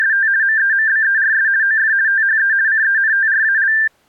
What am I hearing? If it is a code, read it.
RTTY (50 baud, 170 Hz shift), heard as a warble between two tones, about 1700 Hz centre. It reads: … MEMBERS OF THE CENTRAL